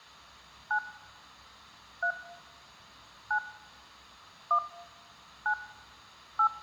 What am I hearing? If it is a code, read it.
DTMF, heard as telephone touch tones, dialled by hand, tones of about 80 ms. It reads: 9 3 9 1 9 8